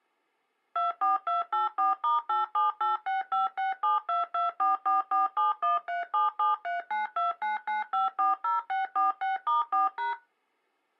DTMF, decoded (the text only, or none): 24284*8786567224447137739299540646*4#